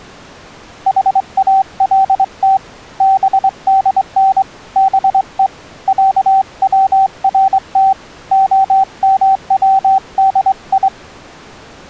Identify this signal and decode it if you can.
Morse code (Persian alphabet), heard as a keyed tone, hand-sent with a straight key, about 23 wpm, 770 Hz. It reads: حالت بدن به صورت عمودی